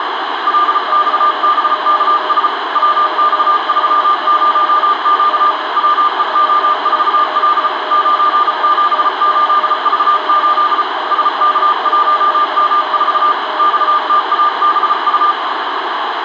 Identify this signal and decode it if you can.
Morse code, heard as two keyed tones, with heavy radio static. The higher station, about 34 wpm, 1200 Hz: LXBKS WX30Q WEO4L 978V8 SK1M4 XTABU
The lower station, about 23 wpm, 620 Hz: CQ QRP DE JA7ATK K SN8WTD